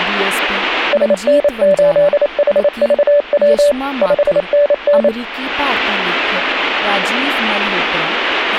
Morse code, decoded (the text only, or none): SN8HVW 5NN